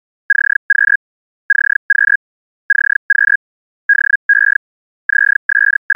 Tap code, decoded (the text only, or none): none